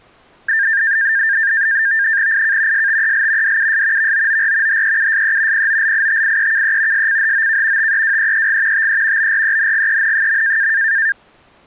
NAVTEX (SITOR-B), 100 baud, 170 Hz shift, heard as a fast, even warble, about 1700 Hz centre. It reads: IK STEL DUS VOOR HEUSE POLITIEKE SCHOK TEWEEG TE BRENGEN.